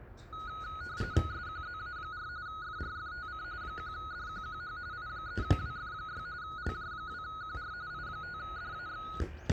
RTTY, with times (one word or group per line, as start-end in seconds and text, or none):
1.3-2.3 SQZA4
2.5-3.4 FRFTC
3.6-4.8 1DQQH
4.9-6.3 I3WF6
6.4-7.7 LJ2QR
7.9-9.1 I5DAX